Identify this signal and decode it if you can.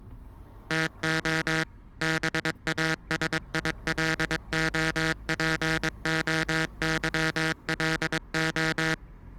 Morse code (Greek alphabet), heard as a buzzer, machine-sent, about 22 wpm, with the noise inside a car. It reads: ΤΟ ΒΑΣΙΛΟΠΟΥΛΟ